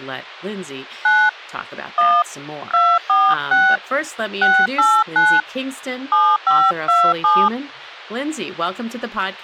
DTMF, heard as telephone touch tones, dialled by hand, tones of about 240 ms, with speech in English. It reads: 9 1 246 689 7527